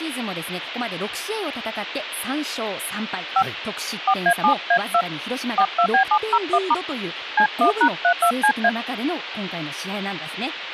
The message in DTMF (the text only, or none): 5 4A7A2 42B701* C1#32CA